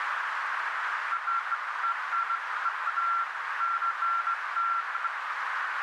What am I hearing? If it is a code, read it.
Beeps of irregular length, with radio static and a narrow filter. There is no code.